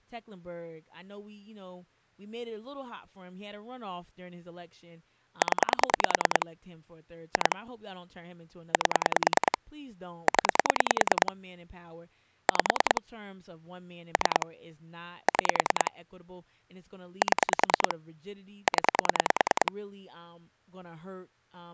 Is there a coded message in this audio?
Yes: pulse dialling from 5.4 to 19.7 s, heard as clicks on a phone line, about 10 pulses a second, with speech in English. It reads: 0 2 8 0 5 3 6 7 0